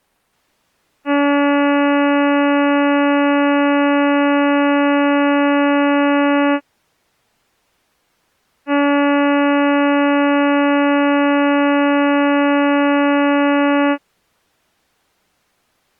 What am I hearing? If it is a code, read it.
Ship horn signal, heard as a ship's horn, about 290 Hz. 2 long. At sea: a vessel under power that has stopped in fog.